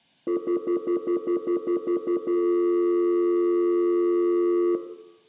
Telephone call progress tone (North American plan), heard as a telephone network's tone, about 350, 440 Hz, 0.1 s on and 0.1 s off, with room echo. Stutter dial tone.